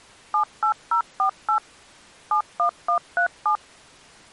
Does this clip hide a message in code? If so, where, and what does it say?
Yes: DTMF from 0.3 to 3.6 s, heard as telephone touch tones, dialled by machine, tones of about 100 ms. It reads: 78048 71137